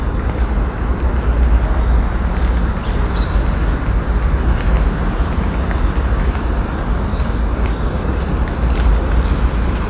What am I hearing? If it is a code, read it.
The noise of a residential street. There is no code.